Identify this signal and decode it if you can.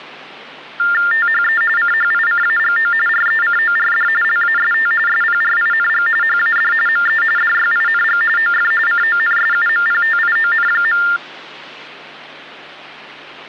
TTY/TDD text telephone tones (45.45 baud Baudot), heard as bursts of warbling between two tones, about 400 Hz shift, 1600 Hz centre, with hum. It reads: THE CHICAGO RECORD LAST SPRING HAD ME DYING OF CONSUMPTION.